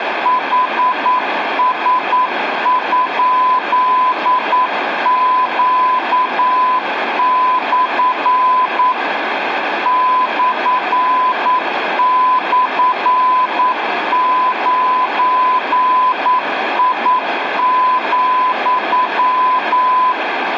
Morse code, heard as a keyed tone, machine-sent, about 9 wpm, 1010 Hz, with radio static and room echo. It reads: HS?Q/ //9I,